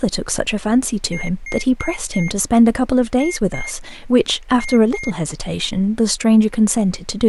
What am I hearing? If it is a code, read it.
Beep code, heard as a piezo beeper, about 2150 Hz, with speech in English. 4-2-2. In Phoenix BIOS tables: shutdown test failure.